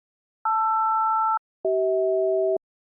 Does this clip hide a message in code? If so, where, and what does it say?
Yes: aircraft SELCAL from 0.5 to 2.6 s, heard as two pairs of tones. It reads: LR-CH